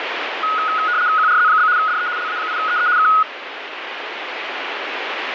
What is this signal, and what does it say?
RTTY (75 baud, 170 Hz shift), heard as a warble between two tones, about 1360 Hz centre, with radio static. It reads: QRZ? DE LA8EE K